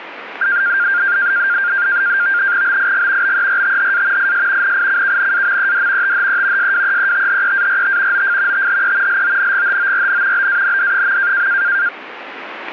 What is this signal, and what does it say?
NAVTEX (SITOR-B), 100 baud, 170 Hz shift, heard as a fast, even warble, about 1500 Hz centre, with radio static. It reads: BIG BERTHA IS NICKNAMED THE SWEETHEART OF THE LONGHORN BAND.